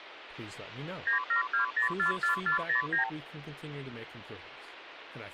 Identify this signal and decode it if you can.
Multi-frequency trunk signalling (R2, with the far end's replies), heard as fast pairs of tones, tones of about 120 ms, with phone line noise and speech in English. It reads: 972044409